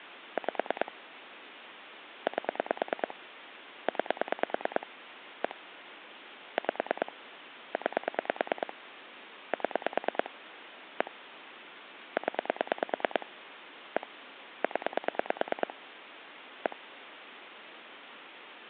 Pulse dialling, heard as clicks on a phone line, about 9 pulses a second, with phone line noise. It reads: 5 8 9 1 5 9 7 1 0 1 0 1